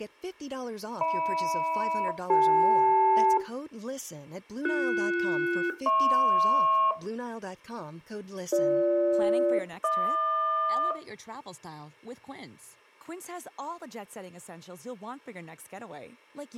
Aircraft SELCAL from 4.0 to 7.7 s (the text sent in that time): BS-HP